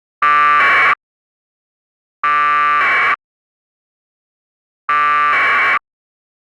Packet radio (AX.25, as in APRS), 1200 baud, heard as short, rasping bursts.